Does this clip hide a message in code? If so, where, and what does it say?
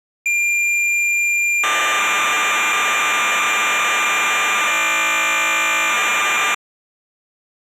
Yes: cassette data (Kansas City type), 1200 baud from 0.3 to 6.5 s, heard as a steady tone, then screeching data.